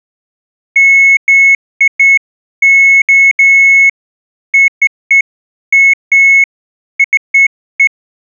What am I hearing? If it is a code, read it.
Beeps of irregular length. There is no code.